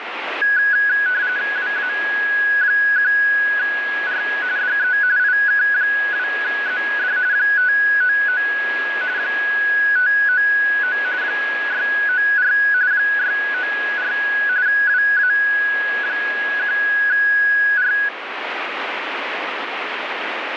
RTTY (45.45 baud, 170 Hz shift), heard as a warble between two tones, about 1550 Hz centre, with radio static. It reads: WA1R DE IK2ZD 599 599 694 694 WA1R